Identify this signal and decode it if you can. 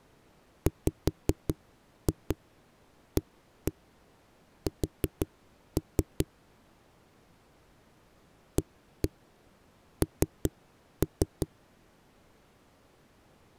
Tap code, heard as knocks on a wall, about 5 knocks a second. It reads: WAS AN